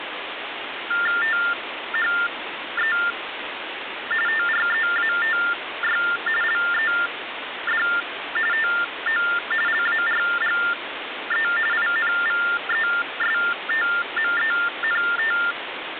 TTY/TDD text telephone tones (45.45 baud Baudot), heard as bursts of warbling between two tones, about 400 Hz shift, 1600 Hz centre, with phone line noise. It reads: THE TREATY LED TO LARGE INVESTMENT